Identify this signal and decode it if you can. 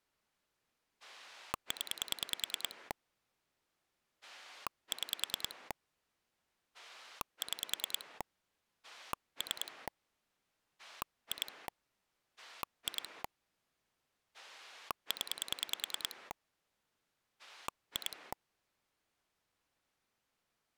Pulse dialling, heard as a rotary dial, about 10 pulses a second. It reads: 0 6 6 3 2 2 0 2